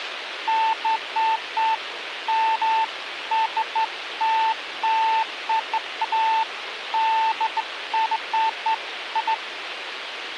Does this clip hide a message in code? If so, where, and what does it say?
No, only beeps of irregular length, with radio hiss and a squelch burst at the end.